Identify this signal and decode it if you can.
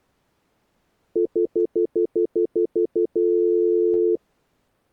Telephone call progress tone (North American plan), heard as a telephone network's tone, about 350, 440 Hz, 0.1 s on and 0.1 s off. Stutter dial tone.